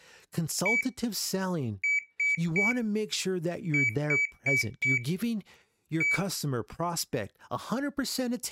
Beep code, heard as a piezo beeper, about 2300 Hz, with speech in English. 1-3-4-1. In Phoenix BIOS tables: memory failure on an address line.